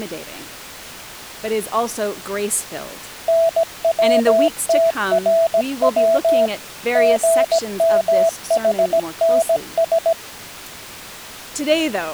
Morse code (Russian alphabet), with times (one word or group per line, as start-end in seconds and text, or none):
3.3-6.5 НВТРВ
7.0-10.1 ГМХНС